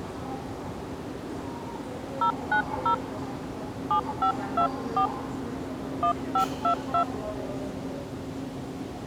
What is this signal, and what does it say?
DTMF, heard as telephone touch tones, dialled by hand, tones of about 90 ms, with the noise of a subway station. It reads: 090 7524 1522